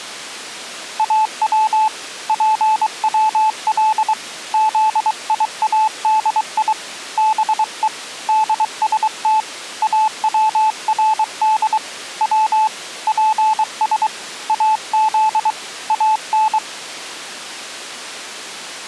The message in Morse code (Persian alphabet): او پول زیادی به دست اورد و پس از ان

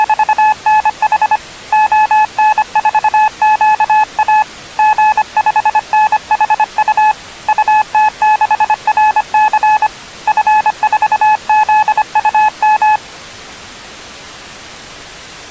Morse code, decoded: … ON4QA G5NHU UT6RC F4ZUM

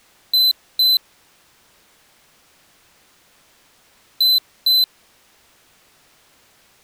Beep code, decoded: 2 short

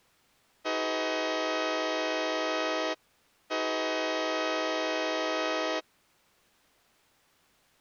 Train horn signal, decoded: 2 long

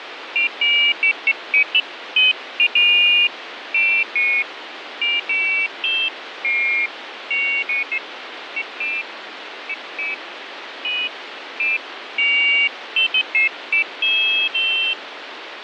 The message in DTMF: none

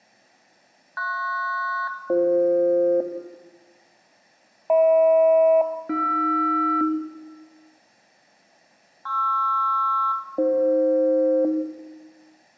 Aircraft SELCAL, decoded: PS-BF HM-AR PR-AF

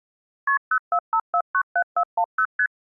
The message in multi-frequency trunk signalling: KP 045497410 ST

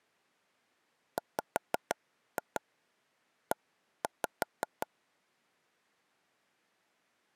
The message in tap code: WE

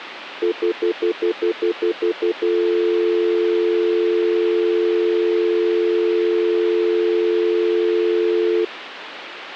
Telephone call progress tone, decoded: stutter dial tone

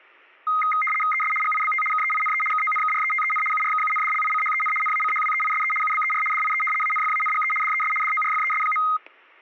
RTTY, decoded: ES GIBT KEINE KONKRETEN URKUNDLICHEN NACHWEISE UBER DIE ANFANGE DES DORFES.

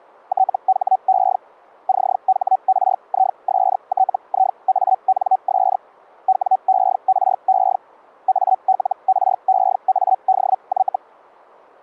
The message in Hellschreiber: THE CHRISTIANS WERE ALREADY

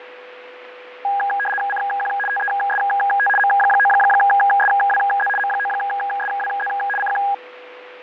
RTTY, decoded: CQ TEST M9SWZ M9SWZ CQ

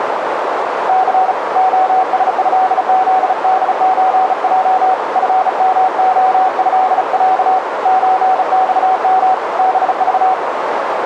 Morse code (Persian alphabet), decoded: ث عسضزدچج فمعضص چخم بذ

